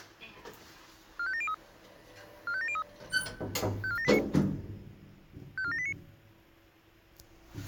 Five-tone selective call (ZVEI), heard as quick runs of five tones, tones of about 70 ms, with the noise inside a lift. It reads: 45703 45703 54789 54789